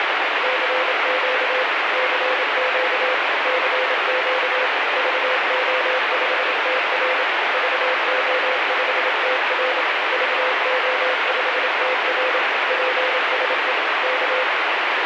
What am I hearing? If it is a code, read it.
Morse code, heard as a keyed tone, machine-sent, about 27 wpm, 510 Hz, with heavy radio static. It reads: CQ CQ CQ VO5TR VO5TR VO5TR PSE K